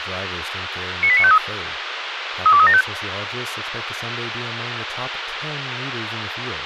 Five-tone selective call (ZVEI), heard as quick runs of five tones, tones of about 70 ms, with radio hiss and speech in English. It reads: 98953 32375